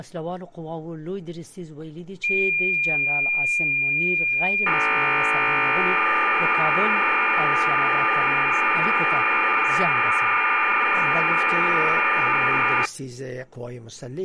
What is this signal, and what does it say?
Cassette data (Kansas City type), 1200 baud, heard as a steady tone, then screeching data.